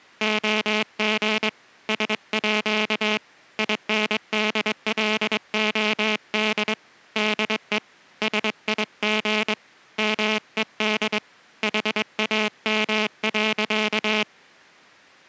Morse code (with Danish letters), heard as a buzzer, hand-sent with a straight key, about 22 wpm. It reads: OG SÅ INDLOD DE SIG MED HAM.